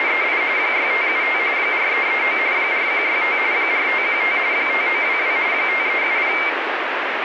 RTTY (45.45 baud, 170 Hz shift), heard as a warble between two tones, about 2200 Hz centre, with radio static. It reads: … 6575 4339 4165 4515 5922 5370